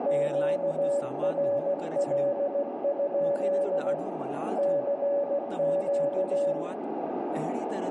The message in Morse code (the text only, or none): QRL? CQ